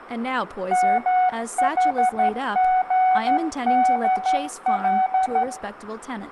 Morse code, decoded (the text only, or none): MHGDL